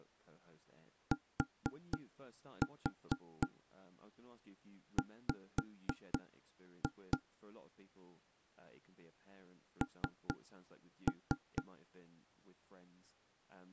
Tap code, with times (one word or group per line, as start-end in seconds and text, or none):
1.1-7.2 TW
9.8-11.6 N